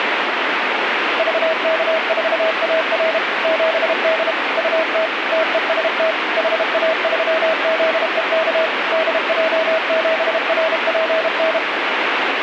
Morse code, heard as a keyed tone, machine-sent, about 32 wpm, 640 Hz, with radio static. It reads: VK4AR 7D UT TEST HA3ZEK DJ7RPN